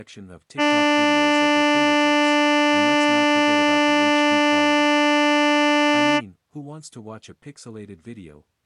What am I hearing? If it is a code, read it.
Ship horn signal, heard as a ship's horn, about 300 Hz, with speech in English. 1 long. At sea: a vessel nearing a blind bend, or under power and making way in fog.